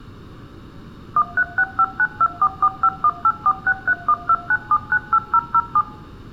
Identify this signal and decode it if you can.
DTMF, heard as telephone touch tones, dialled by machine, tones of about 60 ms. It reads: 13659244518463129798007